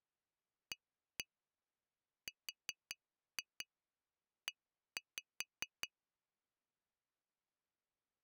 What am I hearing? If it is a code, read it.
Tap code, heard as taps on glass, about 5 knocks a second. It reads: ARE